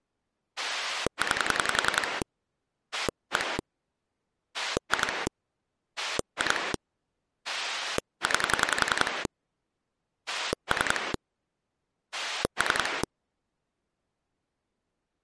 Pulse dialling, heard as a rotary dial, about 10 pulses a second. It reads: 9 1 2 2 9 3 3